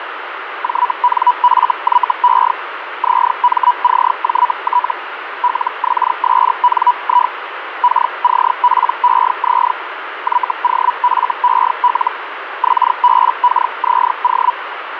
Hellschreiber (Feld-Hell, 122.5 baud), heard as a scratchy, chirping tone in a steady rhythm, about 980 Hz, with radio static. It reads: JNFYE ZMCJT LXSNI KCPEZ YOFEL XBKZO